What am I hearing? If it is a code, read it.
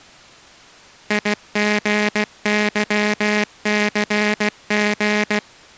Morse code, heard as a buzzer, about 16 wpm. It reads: IGYCG